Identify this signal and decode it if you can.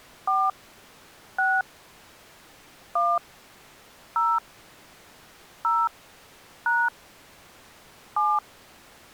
DTMF, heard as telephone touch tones, dialled by hand, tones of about 230 ms. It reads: 4 6 1 0 0 # 7